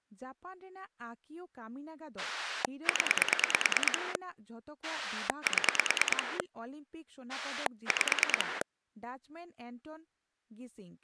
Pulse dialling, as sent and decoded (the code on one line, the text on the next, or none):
10 / 7 / 5
0 7 5